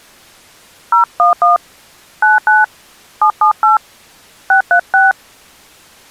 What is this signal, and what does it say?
DTMF, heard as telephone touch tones, dialled by hand, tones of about 130 ms. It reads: 011 99 778 636